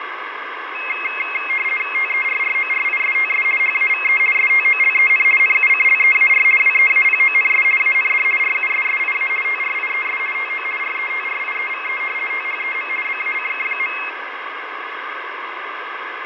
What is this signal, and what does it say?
RTTY (50 baud, 450 Hz shift), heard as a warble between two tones, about 2350 Hz centre, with radio static and fading. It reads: TERRORISTS HAVE STOLEN NUCLEAR WEAPONS AND RUSSIA TRIES TO RETRIEVE THEM BACK.